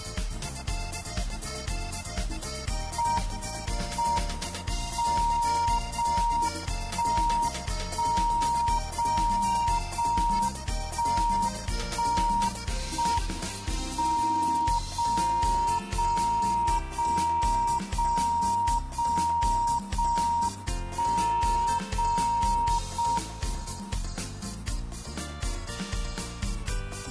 Radio time signal (JJY), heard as a tone whose level steps once a second, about 940 Hz, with static crashes. The time is 04:37 Japan time. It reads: M M 0 1 1 0 0 1 1 1 M 0 0 0 0 0 0 1 0 0 M